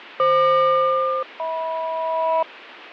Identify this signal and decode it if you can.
Aircraft SELCAL, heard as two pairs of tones, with radio static and fading. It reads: FQ-HM